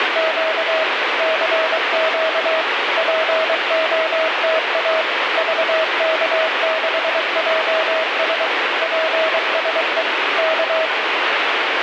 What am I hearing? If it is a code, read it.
Morse code, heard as a keyed tone, machine-sent, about 23 wpm, 640 Hz, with heavy radio static. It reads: … CQ POTA VK6JS PSE K